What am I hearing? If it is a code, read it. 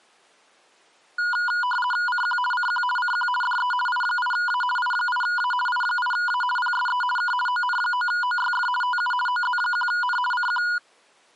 RTTY (50 baud, 450 Hz shift), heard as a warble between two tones, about 1220 Hz centre. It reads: CQ CQ CQ DE I8A I8A I8A PSE K ON9OYF TU OZ1N CQ